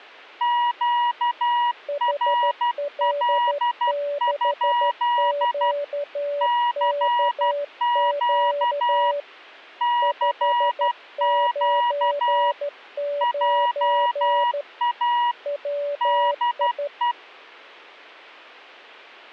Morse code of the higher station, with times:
0.4-5.7 QRL?
6.4-9.1 CQ
9.8-12.5 CQ
13.2-15.3 JA
16.0-17.1 DE

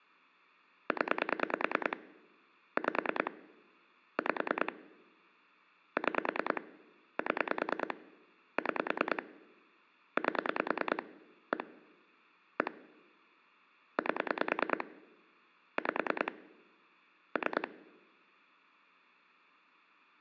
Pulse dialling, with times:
0.9-2.0 0
2.8-3.3 5
4.2-4.7 5
6.0-6.6 6
7.2-7.9 7
8.6-9.2 6
10.2-11.0 8
11.5-11.6 1
12.6-12.7 1
14.0-14.8 8
15.8-16.3 5
17.4-17.7 3

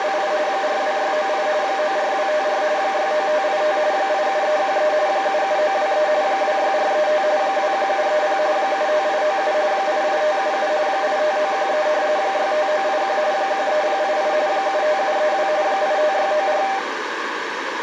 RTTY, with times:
0.0-0.3 …
0.5-1.5 42698
1.6-2.6 94254
2.8-3.8 69585
3.9-4.9 87313
5.1-6.1 77923
6.2-7.2 26435
7.4-8.4 21730
8.6-9.5 75897
9.7-10.7 88577
10.9-11.9 85913
12.2-13.2 65981
13.3-14.3 13088
14.5-15.5 75732
15.6-16.6 85694

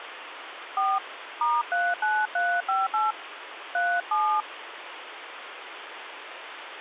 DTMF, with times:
0.8-1.0 4
1.4-3.1 *39358
3.7-4.4 37

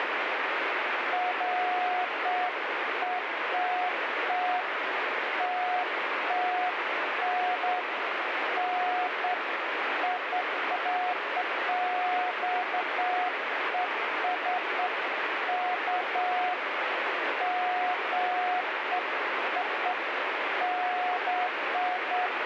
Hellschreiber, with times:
none

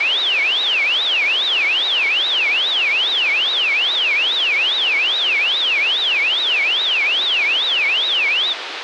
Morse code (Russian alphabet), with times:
none

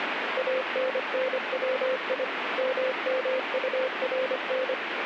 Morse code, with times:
0.4-2.2 ANNWI
2.6-4.7 MMURN

